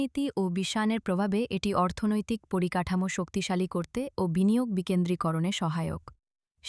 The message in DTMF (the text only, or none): none